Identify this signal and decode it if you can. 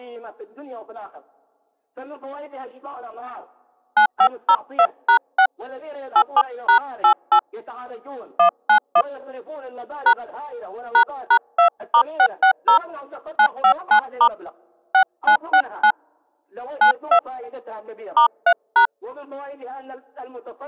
DTMF, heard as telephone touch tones, dialled by hand, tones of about 80 ms. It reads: 9502#6 87#88 191 # ##2*660 959* 6969 92 *3#